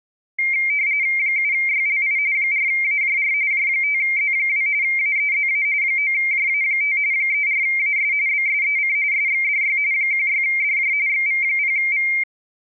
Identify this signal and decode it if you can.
RTTY (45.45 baud, 170 Hz shift), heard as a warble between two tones, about 2200 Hz centre. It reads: 7YLI 4AJR J5Z2 AEZA 9JA5 34AS BSEC SXDY 16DJ XV0V